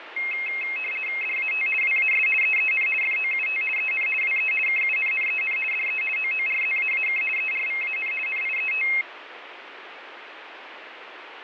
RTTY (50 baud, 450 Hz shift), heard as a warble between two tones, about 2350 Hz centre, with radio static and fading. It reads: DAT WAS EEN FOUT EN WE KUNNEN DE OORZAAK ERVAN NIET